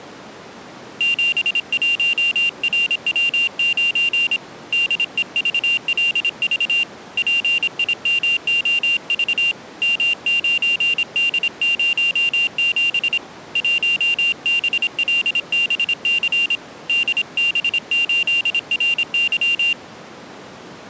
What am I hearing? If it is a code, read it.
Morse code, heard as a high beeper, hand-sent with a paddle, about 26 wpm, 2800 Hz. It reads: 71RW9 DEVLV PIMOV M9D07 1BLBC DB8RY